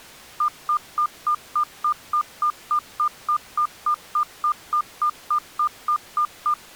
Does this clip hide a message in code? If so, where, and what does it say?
No, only evenly repeated beeps.